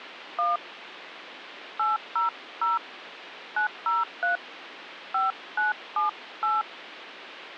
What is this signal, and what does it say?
DTMF, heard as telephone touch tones, dialled by hand, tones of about 140 ms, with phone line noise. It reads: 1 800 903 5978